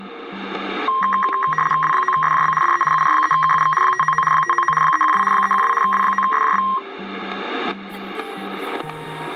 RTTY (75 baud, 850 Hz shift), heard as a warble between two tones, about 1480 Hz centre, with static crashes. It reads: W9SJB DE UR3KUV 599 599 312 312 W9SJB